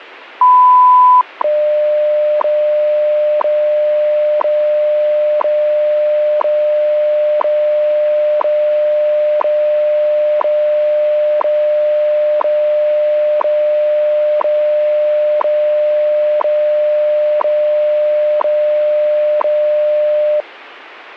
Radio time signal (WWV, Colorado), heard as ticks, one a second.